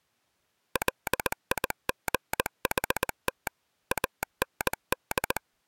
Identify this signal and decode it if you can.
Morse code, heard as a telegraph sounder, machine-sent, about 19 wpm. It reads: LIGHT AND